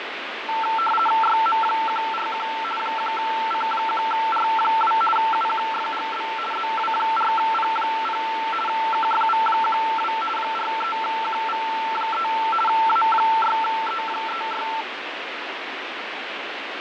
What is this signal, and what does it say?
RTTY (50 baud, 450 Hz shift), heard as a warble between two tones, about 1120 Hz centre, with radio static and fading. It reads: YM141 1C1R2 UQFGB ZW4P0 KFV12 43QV3 A6E36